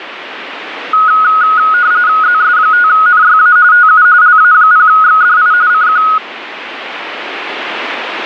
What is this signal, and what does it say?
RTTY (45.45 baud, 170 Hz shift), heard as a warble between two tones, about 1360 Hz centre, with radio static. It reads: ZS5NYA TU LA0XDI CQ